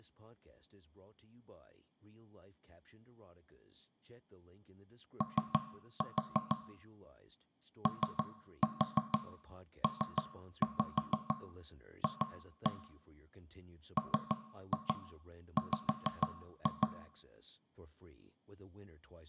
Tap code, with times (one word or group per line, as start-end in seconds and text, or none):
5.2-6.6 O
7.9-12.7 OPF
14.0-16.9 MW